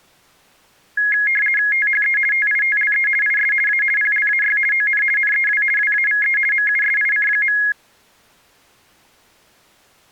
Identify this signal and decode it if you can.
RTTY (50 baud, 450 Hz shift), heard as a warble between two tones, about 1900 Hz centre. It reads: THE TITLE IS A PLAY ON NEW WAVE MUSIC.